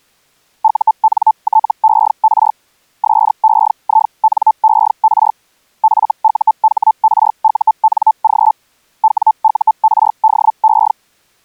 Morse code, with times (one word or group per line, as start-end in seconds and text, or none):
none